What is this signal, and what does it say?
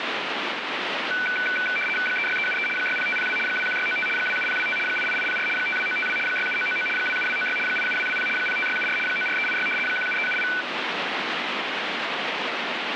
RTTY (75 baud, 850 Hz shift), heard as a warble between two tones, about 1900 Hz centre, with radio static. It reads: 36373 60502 21695 27025 88804 52952 67999 27296 87220 05674 94386 17378